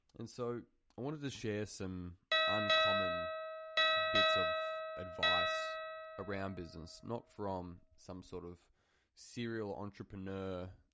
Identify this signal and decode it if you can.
Ship's bell, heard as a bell, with room echo and speech in English. 5. Five half-hours of the watch have passed.